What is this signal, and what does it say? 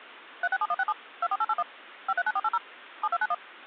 DTMF, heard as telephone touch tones, dialled by machine, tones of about 50 ms. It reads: 367167 24881 539480 7291